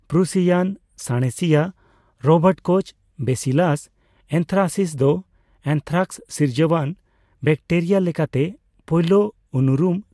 Speech in Santali. There is no code.